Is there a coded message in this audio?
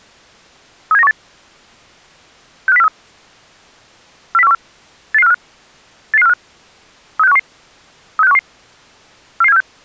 Yes: five-tone selective call (EEA) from 0.9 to 9.6 s, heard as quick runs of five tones, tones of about 40 ms. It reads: 37918 65043 40414 88545 88545 36511 36511 44746